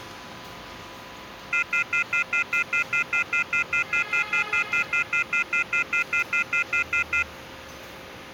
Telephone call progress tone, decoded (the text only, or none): off-hook warning tone